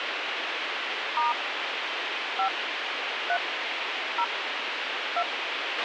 DTMF, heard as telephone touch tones, dialled by hand, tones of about 110 ms, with radio hiss and a squelch burst at the end. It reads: * 5 3 0 2